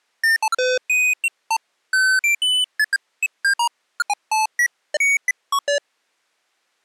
Electronic bleeps of random pitch and length. There is no code.